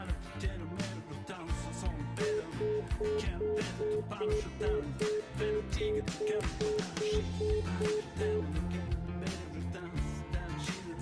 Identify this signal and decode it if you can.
Telephone call progress tone (single-tone plan, as in most of Europe), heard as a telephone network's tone, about 420 Hz, 0.2 s on and 0.2 s off, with room echo. Congestion tone.